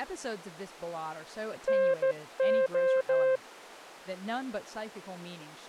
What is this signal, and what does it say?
Morse code (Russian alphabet), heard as a keyed tone, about 14 wpm, 530 Hz, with speech in English. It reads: НО